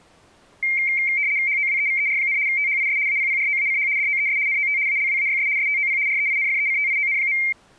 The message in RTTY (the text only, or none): HOWEVER, THIS APPROACH DOES NOT ALWAYS STOP REINFECTION.